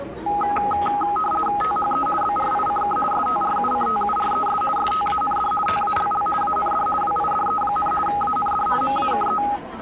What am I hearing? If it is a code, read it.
RTTY (50 baud, 450 Hz shift), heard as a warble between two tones, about 1040 Hz centre, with the noise of a crowd indoors. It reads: THE BRICK STRUCTURES STAND TALL AND WIDE, AND MAKE